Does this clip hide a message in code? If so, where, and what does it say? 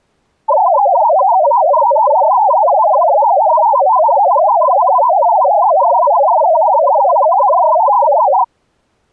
Yes: multi-tone FSK (Olivia or MFSK type), about 500 Hz wide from 0.5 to 8.5 s, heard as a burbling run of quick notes, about 62.5 baud.